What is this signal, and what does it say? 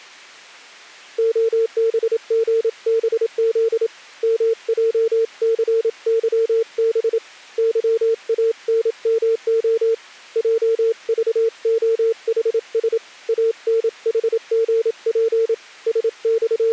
Morse code, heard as a keyed tone, hand-sent with a paddle, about 27 wpm, 450 Hz. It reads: OBGBZ MJCYB YANMO JVOHS ANHGP …